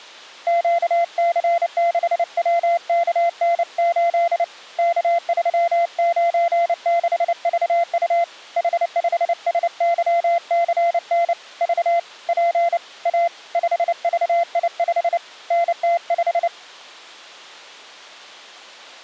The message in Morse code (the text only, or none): QC6WKN8 K396VU H5SYCN V P A 5VI5 NT5